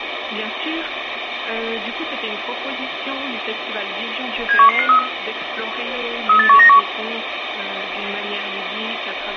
Five-tone selective call (CCIR), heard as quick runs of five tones, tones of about 100 ms, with radio hiss. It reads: 71153 38191